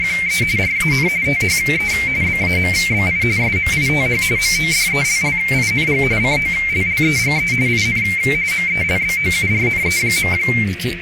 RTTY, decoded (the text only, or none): … RAN THE BAMBI SMITH MODELLING COLLEGE IN MELBOURNE.